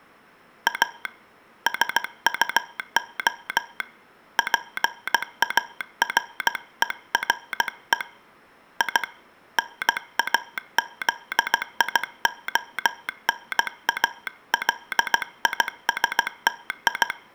Morse code, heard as a telegraph sounder, hand-sent with a paddle, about 16 wpm. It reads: A SUO PARERE I NAZIONALISTI